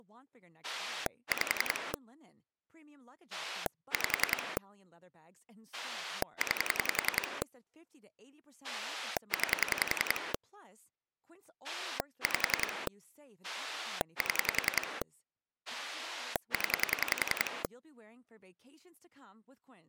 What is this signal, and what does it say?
Pulse dialling, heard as a rotary dial, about 10 pulses a second, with speech in Swedish. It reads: 5 5 9 9 5 7 0